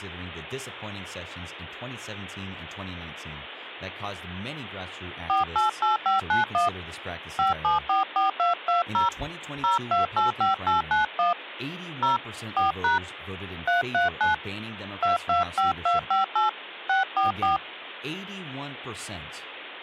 DTMF, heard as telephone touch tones, dialled by hand, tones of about 140 ms, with speech in English. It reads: 488591 5744220 0285891 0 4# 339 225258 644